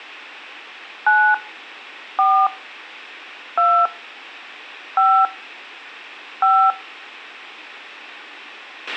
DTMF, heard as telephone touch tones, dialled by hand, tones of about 280 ms, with a squelch burst at the end. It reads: 9 4 2 5 5